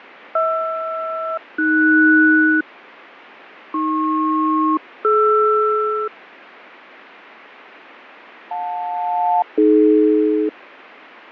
Aircraft SELCAL, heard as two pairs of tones, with radio static and fading. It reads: HR-AS AP-DR JL-AD